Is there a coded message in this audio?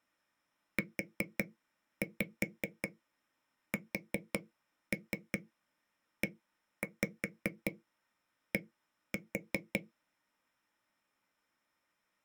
Yes: tap code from 0.8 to 9.8 s, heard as taps on a table, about 5 knocks a second. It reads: USED